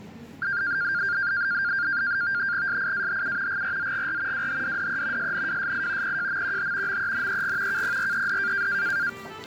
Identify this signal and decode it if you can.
NAVTEX (SITOR-B), 100 baud, 170 Hz shift, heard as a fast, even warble, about 1500 Hz centre, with static crashes and the noise of a subway station. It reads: SIAHU GRZGR WHDDE SNWSI PJMQH MENEG KPRED